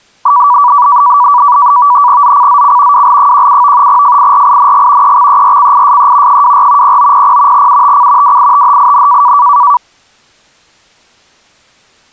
NAVTEX (SITOR-B), 100 baud, 170 Hz shift, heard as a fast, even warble, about 1060 Hz centre. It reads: ZCZC WL17 FIRING EXERCISE 24 0900 UTC WITHIN